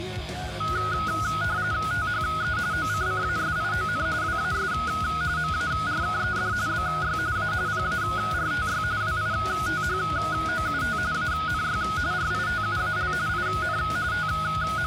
RTTY (45.45 baud, 170 Hz shift), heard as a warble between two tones, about 1360 Hz centre. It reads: THE OCCASION WAS MARKED BY A PARTY WITHOUT ANY RITUAL IN …